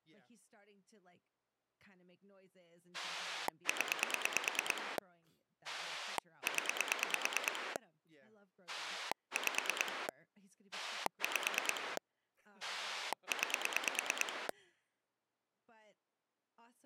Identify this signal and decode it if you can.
Pulse dialling, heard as a rotary dial, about 9 pulses a second, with speech in English. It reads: 0 0 5 5 9